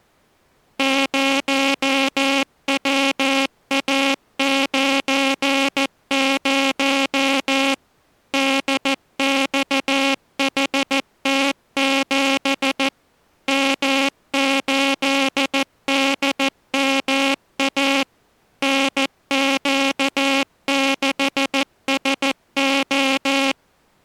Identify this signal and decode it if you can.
Morse code, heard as a buzzer, machine-sent, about 14 wpm. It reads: 0WA90 DXHT7 M8DMA NQ6SO